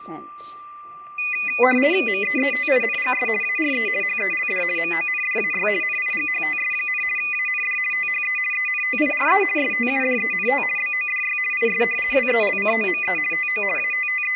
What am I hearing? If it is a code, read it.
RTTY (50 baud, 450 Hz shift), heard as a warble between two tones, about 2250 Hz centre, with static crashes and a steady whistle near 1180 Hz. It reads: MEETINGS ARE HELD MONDAY NIGHTS, AND THE ENTIRE STUDENT BODY IS WELCOME TO …